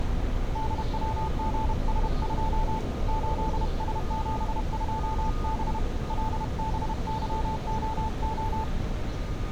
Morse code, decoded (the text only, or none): DWGS2 8S72B LBYOO